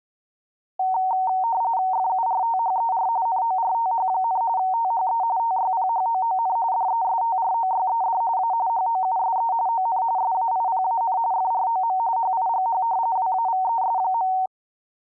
RTTY (45.45 baud, 170 Hz shift), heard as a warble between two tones, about 840 Hz centre. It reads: FURTHER NORTH, THE TYPHOON DESTROYED A HOUSE ON SAIPAN FROM HIGH WAVES.